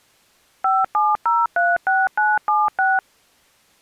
DTMF, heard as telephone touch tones, dialled by machine, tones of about 200 ms. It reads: 57036976